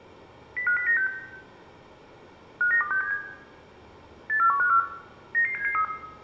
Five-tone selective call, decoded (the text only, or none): 05096 59267 84154 99773